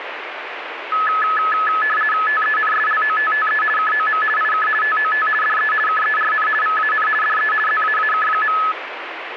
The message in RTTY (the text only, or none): TENSLOTTE KOM IK TOT DE KERN VAN DE ZAAK.